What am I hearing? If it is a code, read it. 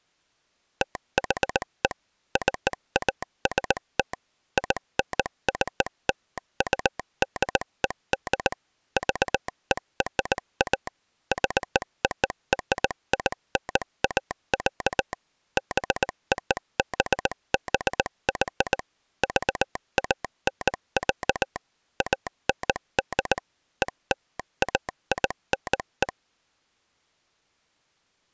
Morse code (American railroad code), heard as a telegraph sounder, machine-sent. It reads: THE CAST INCLUDED VERA ZORINA, BOBBY VAN, AND ELAINE